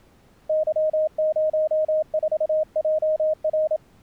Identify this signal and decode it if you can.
Morse code, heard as a keyed tone, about 27 wpm, 620 Hz. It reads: Y04JR